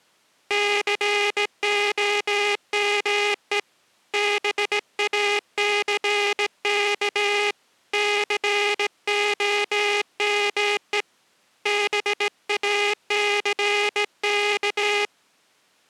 Morse code, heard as a buzzer, hand-sent with a straight key, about 17 wpm. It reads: COME BACK COME BACK